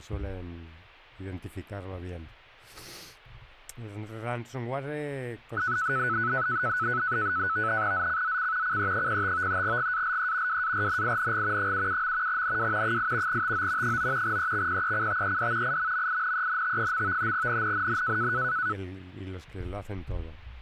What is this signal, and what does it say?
NAVTEX (SITOR-B), 100 baud, 170 Hz shift, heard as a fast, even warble, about 1390 Hz centre. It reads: ZCZC CE05 GALE WARNING 77. NW 8 TO 9 EXPECTED IMMINENT. NNNN